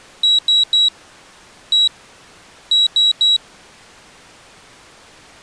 Beep code, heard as a piezo beeper, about 3900 Hz. 3-1-3. In Phoenix BIOS tables: interrupt mask register failure.